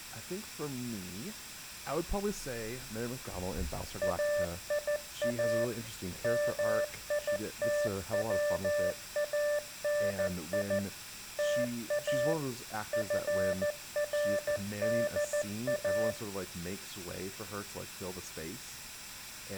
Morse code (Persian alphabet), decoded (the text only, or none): ایا میتوانی تا فردا